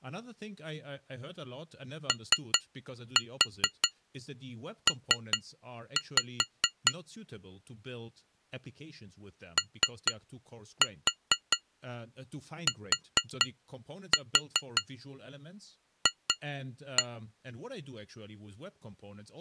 Tap code, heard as taps on glass, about 4 knocks a second, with speech in English. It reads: OP OTF